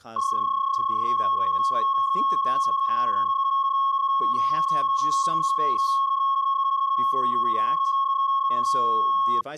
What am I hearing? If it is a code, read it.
PSK31 (31.25 baud), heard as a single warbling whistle, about 1090 Hz, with speech in English.